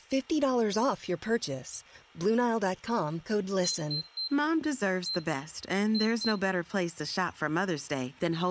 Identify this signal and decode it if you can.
Beep code, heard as a piezo beeper, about 4100 Hz, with room echo and speech in Swedish. 3-1-2. In Phoenix BIOS tables: DMA register failure.